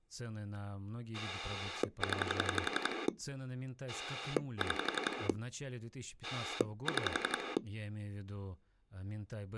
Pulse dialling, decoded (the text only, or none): 0 6 6